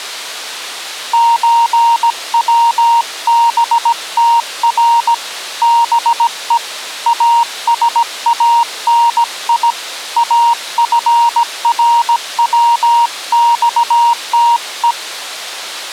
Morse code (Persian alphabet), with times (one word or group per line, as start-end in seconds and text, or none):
1.1-5.1 چوبتر
5.6-6.6 به
7.1-9.7 اسانی
10.2-14.9 افروخته